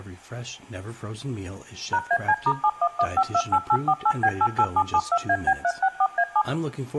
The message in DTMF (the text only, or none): #AC*711528848B88772AB364A7